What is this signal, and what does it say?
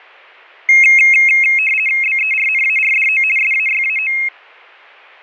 RTTY (50 baud, 450 Hz shift), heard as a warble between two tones, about 2350 Hz centre, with fading. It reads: BERNARDO SAYAO